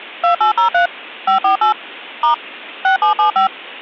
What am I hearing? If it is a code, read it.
DTMF, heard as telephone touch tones, dialled by machine, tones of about 110 ms. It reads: 2803 548 * 6775